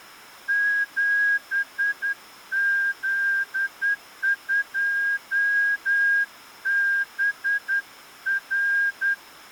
Morse code, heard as a whistle, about 10 wpm. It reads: 7Z2BR